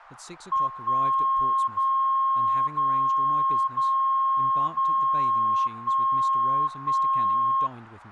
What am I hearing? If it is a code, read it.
Radio time signal (DCF77), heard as a tone whose level steps once a second, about 1070 Hz, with speech in English. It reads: 1 0 0 0 0 1 1